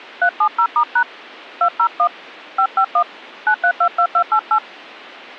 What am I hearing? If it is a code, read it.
DTMF, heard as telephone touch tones, dialled by hand, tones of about 80 ms. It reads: 370*# 201 551 9322288